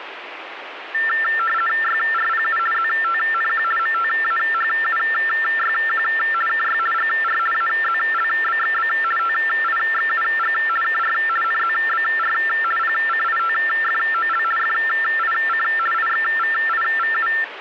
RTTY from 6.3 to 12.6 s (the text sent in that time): KY GR AZLBXB TIXUG KR NZBR